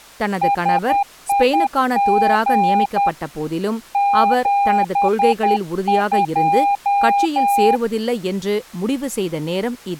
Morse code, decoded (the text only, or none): SIG 72